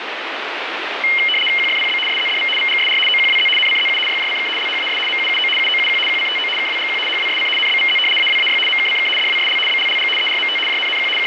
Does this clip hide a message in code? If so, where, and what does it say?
Yes: RTTY (75 baud, 850 Hz shift) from 1.0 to 11.3 s, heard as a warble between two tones, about 2550 Hz centre, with radio static. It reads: QFPB SZDV VGSR OQWZ NCZU YJCK LHAS MUUO UOUQ QCTO KWGQ HWSC NBVZ AWAY MKCK DWSL BLLG ERMT JNNQ …